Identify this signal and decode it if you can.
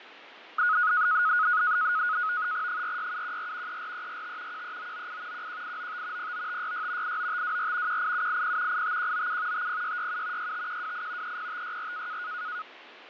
NAVTEX (SITOR-B), 100 baud, 170 Hz shift, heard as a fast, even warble, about 1360 Hz centre, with radio static and fading. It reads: 46714 34345 13998 11895 09566 89524 18780 85197 50667 65128 30564